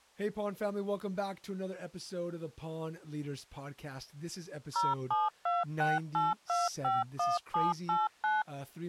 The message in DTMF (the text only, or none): 07268251789